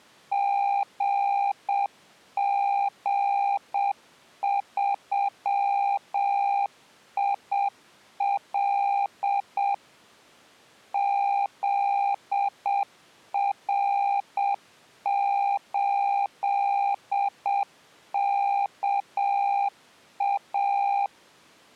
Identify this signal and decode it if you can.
Morse code, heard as a keyed tone, machine-sent, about 7 wpm, 800 Hz. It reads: GG3IL ZR8KA